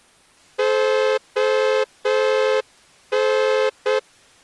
Morse code (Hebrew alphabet), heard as a horn, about 7 wpm. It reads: הן